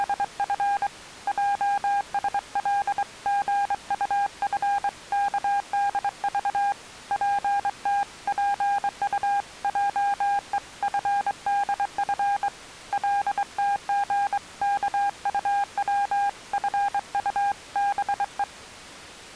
Morse code (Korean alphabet), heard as a keyed tone, hand-sent with a straight key, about 23 wpm, 810 Hz. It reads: … 혁신을 저지하는 것입니다